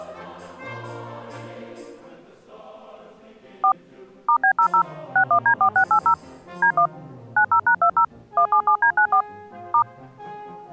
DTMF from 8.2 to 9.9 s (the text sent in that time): 177D94 *